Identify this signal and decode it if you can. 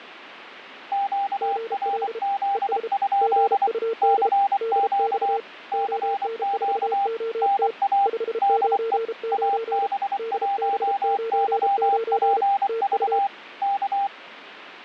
Morse code, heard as two keyed tones. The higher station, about 24 wpm, 800 Hz: QRZ? CQ CQ NA DE AB1YPV K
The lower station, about 33 wpm, 450 Hz: GL ES GUD DX ON4OT 599 DB99 TU